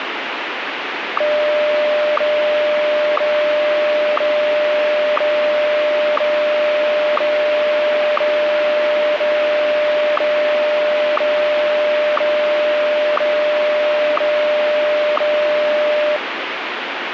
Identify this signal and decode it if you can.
Radio time signal (WWVH, Hawaii), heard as ticks, one a second, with radio static.